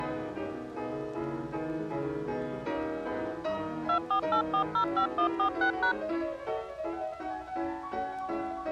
DTMF, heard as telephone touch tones, dialled by machine, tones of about 90 ms. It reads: 248405146#